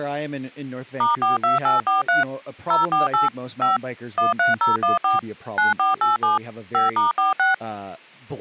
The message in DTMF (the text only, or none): *42843 048 5 13014 9487 5*46